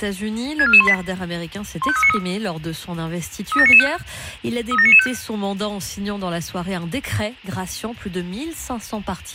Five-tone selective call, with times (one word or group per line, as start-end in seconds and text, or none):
0.6-0.9 64418
1.8-2.2 15393
3.5-3.9 37995
4.7-5.1 37995